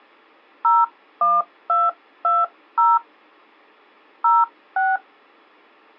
DTMF, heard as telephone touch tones, dialled by hand, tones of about 200 ms. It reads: 01220 06